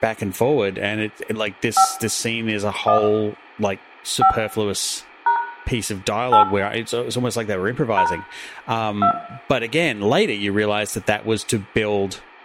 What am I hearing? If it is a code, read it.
DTMF, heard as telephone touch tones, dialled by hand, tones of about 100 ms, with room echo and speech in English. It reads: 5 1 5 # 8 # 2